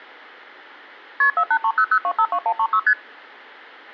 Multi-frequency trunk signalling (R1, as on North American trunks), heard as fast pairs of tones, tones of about 70 ms. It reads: KP 48300252136 ST